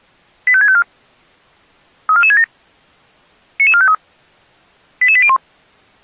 Five-tone selective call (ZVEI), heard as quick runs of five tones, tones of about 70 ms. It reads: 85654 34467 99453 88801